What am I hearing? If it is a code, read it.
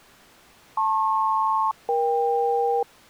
Aircraft SELCAL, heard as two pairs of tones. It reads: LP-EK